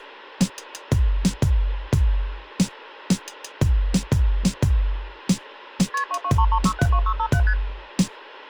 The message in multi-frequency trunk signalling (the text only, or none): KP 2233672657 ST